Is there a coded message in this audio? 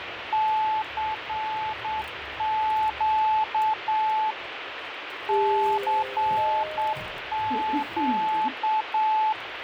Yes: Morse code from 0.3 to 9.4 s, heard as a keyed tone, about 8 wpm, 870 Hz, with radio static, fading and the noise inside a lift. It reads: CQ CQ